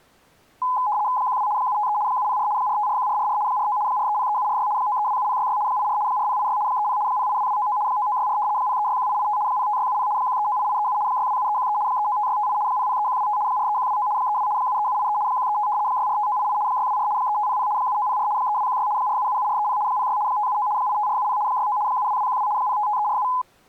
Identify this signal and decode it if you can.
RTTY (75 baud, 170 Hz shift), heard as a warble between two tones, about 920 Hz centre. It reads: 12 753 704 4541444 49 4303746 9327066 84 4086 30 082299 9964 0361885 05670 1398837 627313 395658 003125 43129 32 73783 135 645988 624 3500 7904 3216 4777430 06 579 85470 69 72212 055347